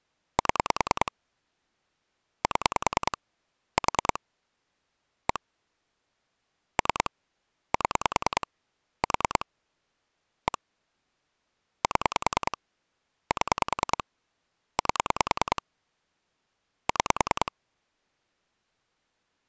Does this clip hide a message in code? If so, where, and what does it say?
Yes: pulse dialling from 0.4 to 17.5 s, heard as clicks on a phone line, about 10 pulses a second. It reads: 7 7 4 1 3 7 4 1 7 7 8 6